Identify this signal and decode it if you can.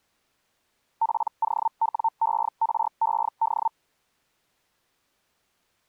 Hellschreiber (Feld-Hell, 122.5 baud), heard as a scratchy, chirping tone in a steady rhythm, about 900 Hz. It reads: POWERED